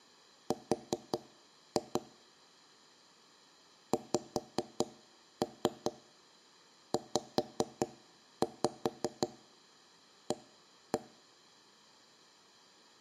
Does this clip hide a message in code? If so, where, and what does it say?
Yes: tap code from 0.5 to 11.0 s, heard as knocks on wood, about 5 knocks a second. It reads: R XZA